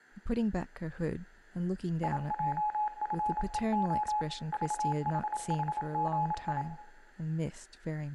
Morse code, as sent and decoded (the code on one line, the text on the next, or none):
.. .--- ..-. . --- / ...- .... .... --. ..
IJFEO VHHGI